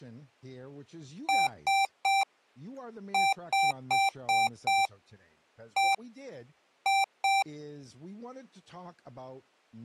Beep code, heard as beeps from a small speaker, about 780 Hz, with speech in English. 3-5-1-2.